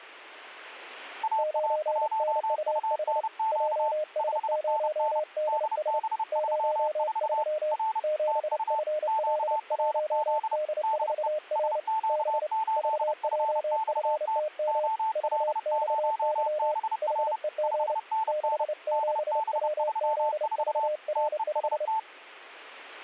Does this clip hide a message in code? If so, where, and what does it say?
Yes: Morse code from 1.2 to 22.1 s, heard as two keyed tones. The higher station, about 30 wpm, 880 Hz: AA1UNQ 5NN DB34 R TU QRZ DE SQ8FXT OL0BR 5NN DB34 TEST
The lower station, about 29 wpm, 610 Hz: 9NUH JS0DS 03 7FL1D4R B VJFTM VXY HEG 67WZVR5